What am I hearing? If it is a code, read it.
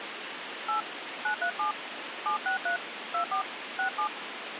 DTMF, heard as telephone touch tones, dialled by hand, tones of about 100 ms, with phone line noise. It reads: 8 937 763 24 67